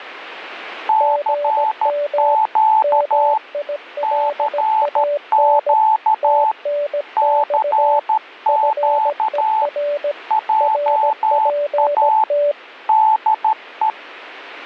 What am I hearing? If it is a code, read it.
Morse code, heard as two keyed tones, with static crashes. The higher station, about 13 wpm, 870 Hz: CQ CQ CQ JA DE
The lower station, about 17 wpm, 580 Hz: GM MILAN TNX FER RPT